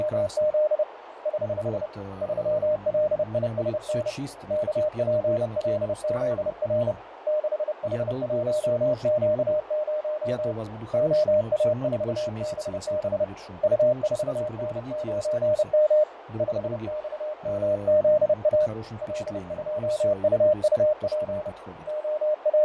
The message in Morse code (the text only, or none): … <HH> 3LISN KPLZR 6H1Q0 OA4BB U4N9M 5XMZA L2UUP …